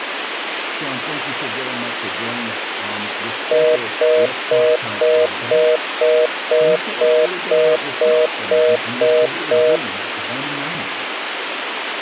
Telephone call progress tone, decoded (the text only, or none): congestion tone